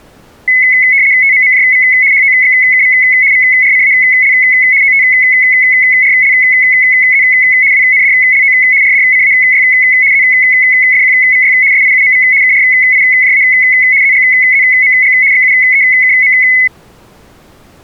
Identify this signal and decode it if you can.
RTTY (75 baud, 170 Hz shift), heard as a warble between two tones, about 2100 Hz centre. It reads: TMMJV HOXKV VRCAL OTRLZ WNDLO RDCAY ZFQVY SIUMV KRIJA ZGZMG XUEKM